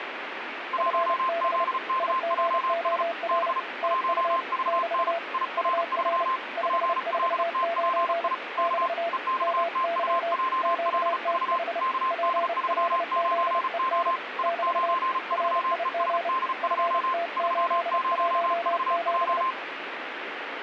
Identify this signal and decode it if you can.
Morse code, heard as two keyed tones, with radio static. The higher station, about 35 wpm, 1050 Hz: 1ZKJS B 1VN IR3 PLTPI K EXTUJLV KD39O I93ESD2 30VJ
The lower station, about 30 wpm, 680 Hz: FB IGOR TU <BT> UR 549 <BT> MY QTH PLZEN <BT> RIG FT817